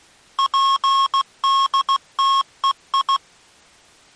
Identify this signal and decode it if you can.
Morse code, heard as electronic beeps, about 16 wpm, 1090 Hz. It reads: PDTEI